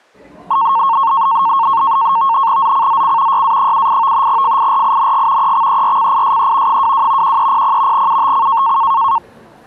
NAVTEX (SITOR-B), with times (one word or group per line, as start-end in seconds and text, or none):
2.6-3.4 ZCZC
3.3-4.3 YA78
4.3-5.5 FIRING
5.4-6.8 EXERCISE
6.7-7.4 22
7.2-8.1 1300
7.9-8.8 UTC